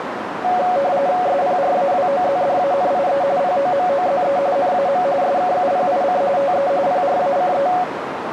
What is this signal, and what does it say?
RTTY (45.45 baud, 170 Hz shift), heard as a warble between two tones, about 640 Hz centre, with radio static and a narrow filter. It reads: SPRAWOZDANIE POMOZE NAM SKUPIC TE PRACE